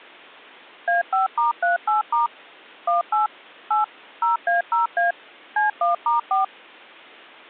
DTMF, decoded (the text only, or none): A5*38* 18 8 0A0A C1*4